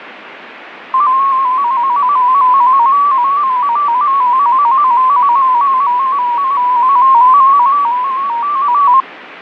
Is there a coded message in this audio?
Yes: multi-tone FSK (Olivia or MFSK type), about 250 Hz wide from 0.9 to 9.0 s, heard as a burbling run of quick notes, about 15.625 baud, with radio static and fading.